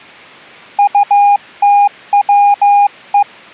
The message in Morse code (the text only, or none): UTWE